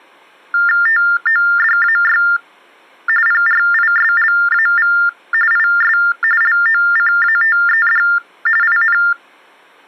TTY/TDD text telephone tones (45.45 baud Baudot), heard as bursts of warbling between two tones, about 400 Hz shift, 1600 Hz centre. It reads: TODAY PRISLAV IS LOCATED IN